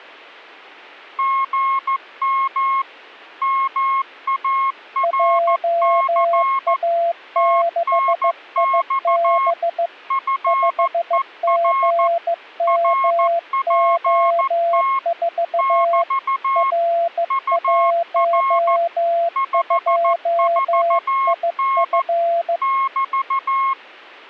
Morse code, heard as two keyed tones. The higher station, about 14 wpm, 1080 Hz: GM MARC TNX FER RPT <BT> UR 54N <BT>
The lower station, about 15 wpm, 680 Hz: JA6IB 5GMO4 R12IF